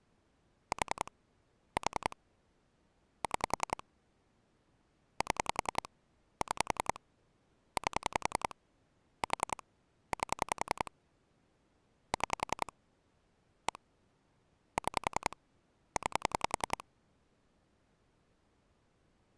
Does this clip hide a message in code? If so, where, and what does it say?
Yes: pulse dialling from 0.7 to 16.8 s, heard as clicks on a phone line, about 10 pulses a second. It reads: 4 4 6 7 6 8 4 8 6 1 6 9